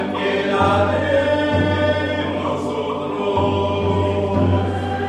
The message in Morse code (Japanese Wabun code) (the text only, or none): none